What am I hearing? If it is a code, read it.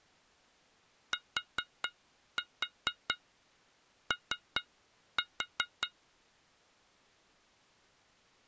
Tap code, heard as taps on glass, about 4 knocks a second. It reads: TO